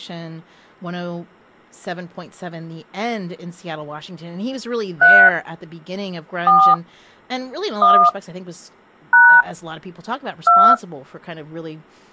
DTMF, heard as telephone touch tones, dialled by hand, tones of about 280 ms, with speech in English. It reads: 3 4 1 # 2